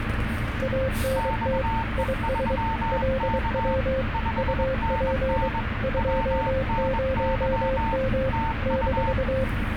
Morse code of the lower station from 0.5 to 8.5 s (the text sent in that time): ANT IS LW UP 20M